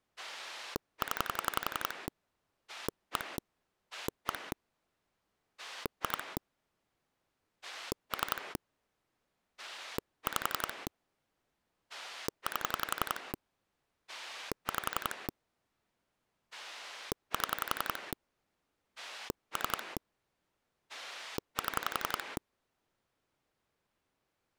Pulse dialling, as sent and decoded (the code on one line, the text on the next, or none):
10 / 1 / 1 / 2 / 3 / 5 / 8 / 5 / 7 / 3 / 7
0 1 1 2 3 5 8 5 7 3 7